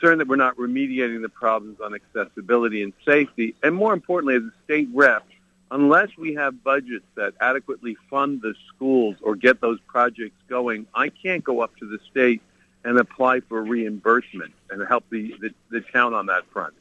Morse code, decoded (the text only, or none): none